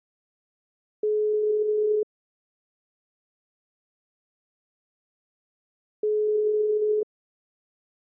Telephone call progress tone (single-tone plan, as in most of Europe), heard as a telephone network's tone, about 420 Hz, 1 s on and 4 s off. Ringback tone.